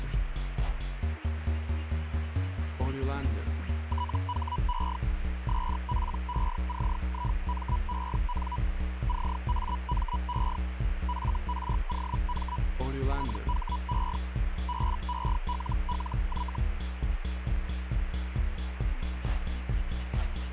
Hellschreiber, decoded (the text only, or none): THE SPECIMEN CAME FROM THE BELLY